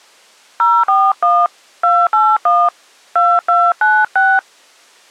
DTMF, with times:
0.6-1.5 041
1.8-2.7 281
3.2-4.4 2296

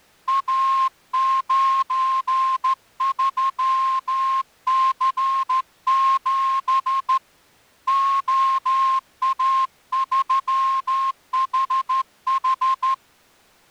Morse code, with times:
0.3-7.2 A93C7
7.9-12.9 OA3HH

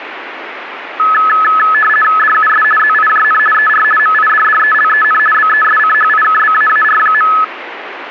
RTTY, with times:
2.2-2.6 DUS
2.8-3.4 ZIJN
3.5-3.8 ER
4.0-5.2 MIDDELEN
5.3-7.3 BESCHIKBAAR.

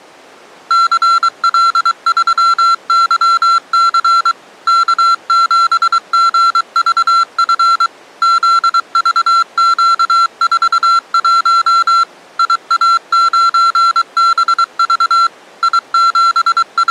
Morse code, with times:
0.7-4.3 CL3YC
4.7-7.9 K7GVF
8.2-12.0 ZVQ41
12.4-15.3 IA9BV
15.6-16.9 …

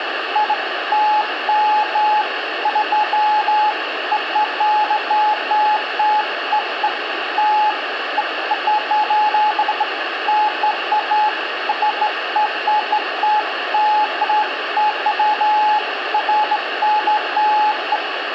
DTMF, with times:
none

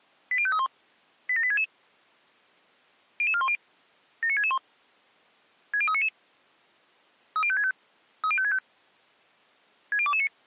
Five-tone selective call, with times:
0.3-0.7 80531
1.3-1.6 87866
3.2-3.6 00410
4.2-4.6 79661
5.7-6.1 60399
7.4-7.7 30565
8.2-8.6 30565
9.9-10.3 60229

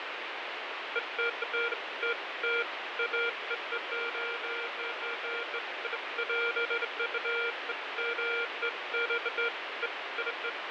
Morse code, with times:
none

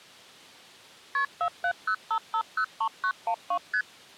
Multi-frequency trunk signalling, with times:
1.1-1.2 KP
1.4-3.6 4705503912
3.7-3.8 ST

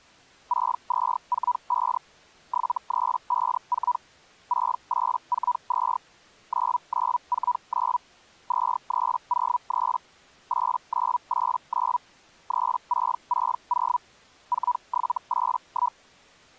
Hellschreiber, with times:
0.5-2.0 6245
2.5-4.0 7354
4.5-6.0 6842
6.5-8.0 9949
8.5-10.0 2303
10.5-12.0 8989
12.5-14.0 3660
14.5-16.0 4781

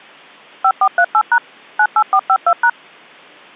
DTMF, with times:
0.6-1.4 5438#
1.8-2.7 98452#

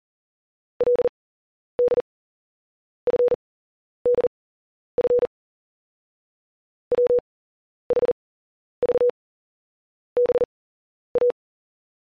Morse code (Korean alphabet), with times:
0.8-5.3 그는
6.9-11.3 불도

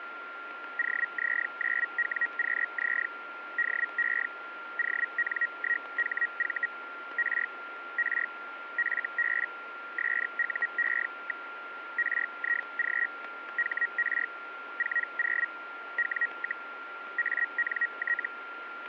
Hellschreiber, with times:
0.8-3.1 OZ9WQZ
3.6-4.3 DE
4.8-6.7 ON1HV
7.2-7.5 R
8.0-8.3 R
8.8-9.5 FB
10.0-11.5 SUE.
12.0-13.1 RIG
13.6-14.3 HR
14.8-15.5 40
16.0-16.7 W,
17.2-18.3 ANT

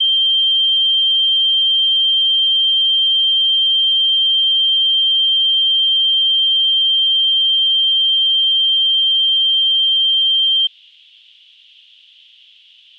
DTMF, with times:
none

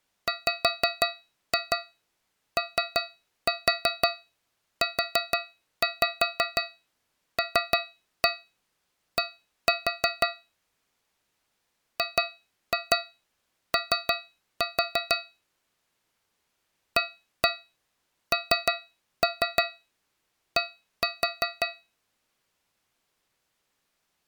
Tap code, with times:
0.3-10.3 WOULD
12.0-15.2 GO
17.0-21.7 AND

